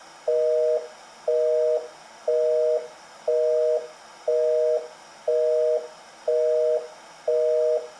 Telephone call progress tone (North American plan), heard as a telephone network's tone, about 480, 620 Hz, 0.5 s on and 0.5 s off. Busy tone.